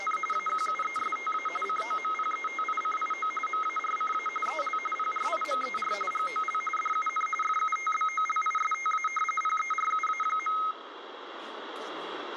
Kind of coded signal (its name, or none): RTTY